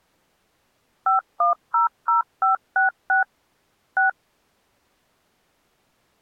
DTMF, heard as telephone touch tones, dialled by machine, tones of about 130 ms. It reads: 5100566 6